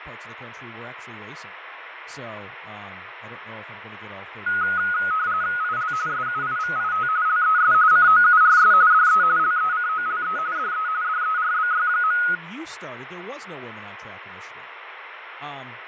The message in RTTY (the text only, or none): IL SUIVIT LES COURS DE LECOLE DE DERBY.